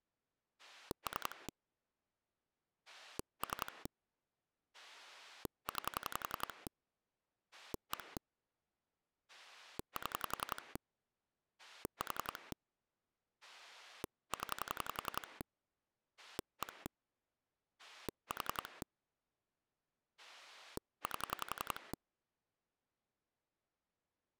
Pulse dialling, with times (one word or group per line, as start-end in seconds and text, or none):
0.6-1.5 3
2.9-3.9 3
4.7-6.7 9
7.5-8.2 1
9.3-10.8 7
11.6-12.5 4
13.4-15.4 0
16.2-16.9 1
17.8-18.8 4
20.2-21.9 8